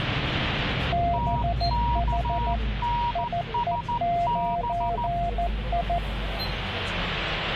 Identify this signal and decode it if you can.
Morse code, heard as two keyed tones, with radio static and the noise inside a bus. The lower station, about 14 wpm, 690 Hz: BH IE9I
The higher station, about 14 wpm, 950 Hz: TKNSB